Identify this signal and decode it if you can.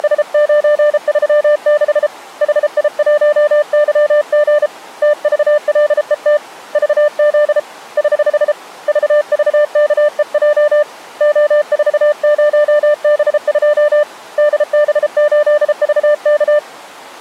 Morse code, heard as a keyed tone, hand-sent with a paddle, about 33 wpm, 600 Hz. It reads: … HI1YG TVLET VZ <HH> VVKEJ O40B2 DB8VK